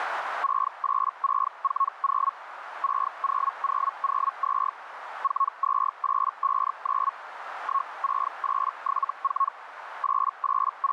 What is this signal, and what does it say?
Hellschreiber (Feld-Hell, 122.5 baud), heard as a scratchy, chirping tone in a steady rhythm, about 1100 Hz, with radio static and a narrow filter. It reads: 68640 60002 42859 16874 …